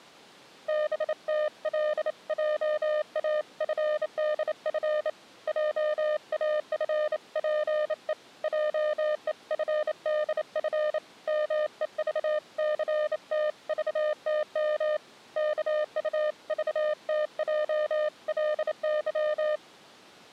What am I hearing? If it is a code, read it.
Morse code (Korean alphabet), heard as a keyed tone, hand-sent with a bug key, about 28 wpm, 610 Hz. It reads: 덕호는 혼자 하는 말처럼 이렇게